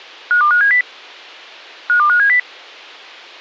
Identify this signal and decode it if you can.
Five-tone selective call (CCIR), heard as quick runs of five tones, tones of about 100 ms. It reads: 52570 52570